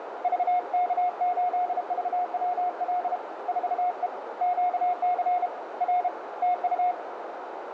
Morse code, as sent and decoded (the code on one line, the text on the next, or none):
...- -.- ---.. ...- .-- .-.. / ....- . / --.- -.-. / .-. / - ..-
VK8VWL 4E QC R TU